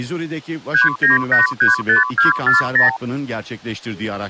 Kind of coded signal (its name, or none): multi-frequency trunk signalling